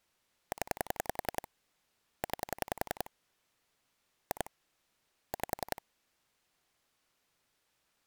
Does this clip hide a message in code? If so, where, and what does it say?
Yes: pulse dialling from 0.5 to 5.8 s, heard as clicks on a phone line, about 10 pulses a second. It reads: 0 9 2 5